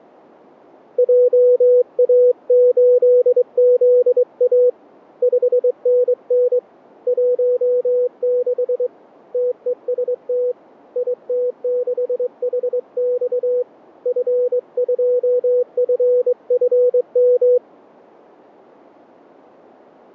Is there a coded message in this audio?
Yes: Morse code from 0.9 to 17.6 s, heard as a keyed tone, hand-sent with a straight key, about 22 wpm, 490 Hz. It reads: JA8ZA 5NN 16 TEST IT6HX F2FFM